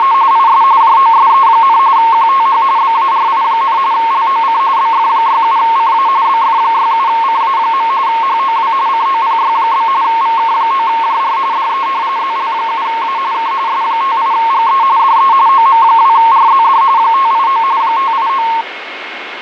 RTTY (45.45 baud, 170 Hz shift), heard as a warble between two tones, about 1000 Hz centre, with radio static, fading and a steady whistle near 2170 Hz. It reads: … IS JOSE, QTH BARI, LOC BF67CA BF67CA. HOW COPY? VK9JR DE ZL7A K S58GE DE OM2RZD 589 589